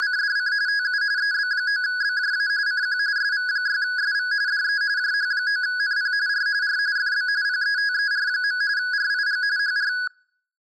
RTTY (45.45 baud, 170 Hz shift), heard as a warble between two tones, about 1550 Hz centre. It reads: … TU EB9BJA CQ SV6SV DE JH9NP R R FB PETER. RIG HR